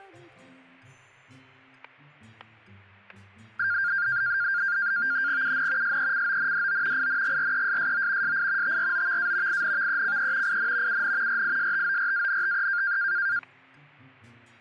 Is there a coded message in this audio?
Yes: NAVTEX (SITOR-B), 100 baud, 170 Hz shift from 3.6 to 13.4 s, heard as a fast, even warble, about 1500 Hz centre, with static crashes. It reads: UN SECONDO INGRESSO SI TROVA INVECE IN UN RISTORANTE